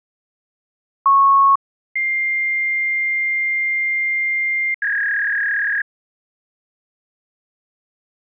Fax machine handshake, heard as a beep, a long tone and a warble.